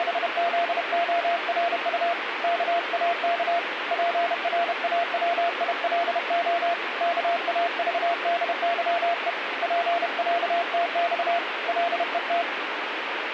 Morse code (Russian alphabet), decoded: … КАК ПРАВИЛО КАЖДЫЕ ПЯТЬ ЛЕТ

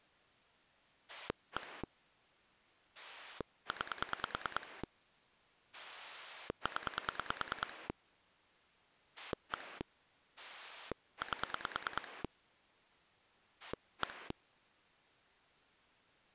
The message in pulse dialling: 1 9 0 1 8 1

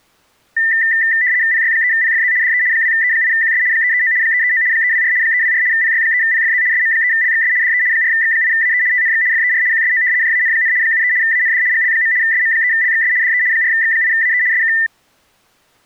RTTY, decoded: PY3PFZ DE 2E8QS 339 339 324 324 PY3PFZ SM3LXS DE 4X8AE TNX FER QSO JAN, 73 AND GL. SM3LXS DE 4X8AE SK

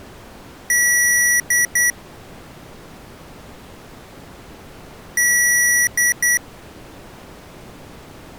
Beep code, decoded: 1 long, 2 short

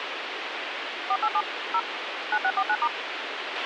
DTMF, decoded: 487 0 9649*

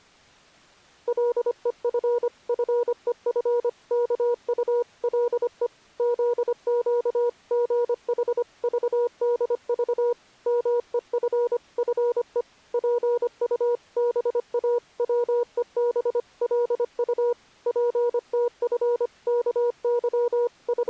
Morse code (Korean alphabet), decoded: 간난이가 태수를 만나 지도받기 …

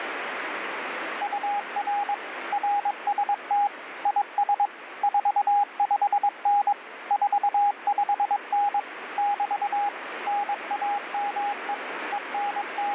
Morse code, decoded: UR RST IS 45N 45N <BT> NAME …

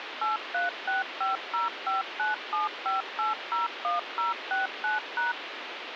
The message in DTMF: 836505975801069#

